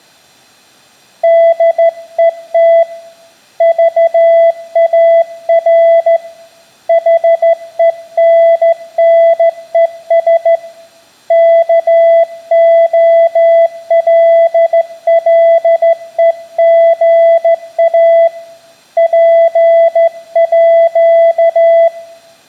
Morse code (with Swedish letters), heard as a keyed tone, hand-sent with a straight key, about 14 wpm, 670 Hz, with room echo. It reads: DET VAR HENNES KOLLEGA PÅ